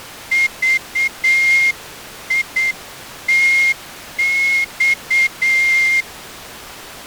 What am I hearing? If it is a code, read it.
Morse code (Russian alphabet), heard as a whistle, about 8 wpm. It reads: ЖИТЬ